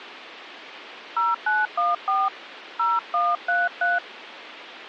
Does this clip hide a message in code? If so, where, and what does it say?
Yes: DTMF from 1.2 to 4.0 s, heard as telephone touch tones, dialled by hand, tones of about 210 ms. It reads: 0914 0133